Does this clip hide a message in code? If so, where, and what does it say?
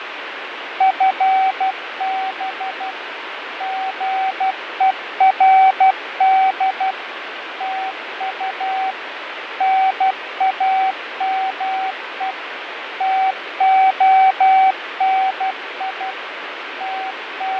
Yes: Morse code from 0.7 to 17.6 s, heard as a keyed tone, machine-sent, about 12 wpm, 760 Hz, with radio static and fading. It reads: FB GERD TU NAME TONI …